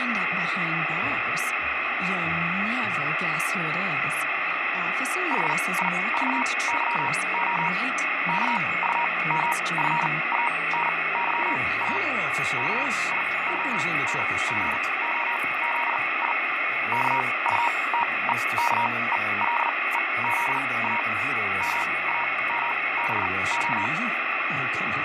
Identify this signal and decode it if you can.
Morse code, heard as a keyed tone, machine-sent, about 39 wpm, spaced as for 23 wpm, 950 Hz, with radio static, fading and a weaker station near 2190 Hz. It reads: HIVYO KUMFANYA KIONGOZI KUTEKELEZA MAMBO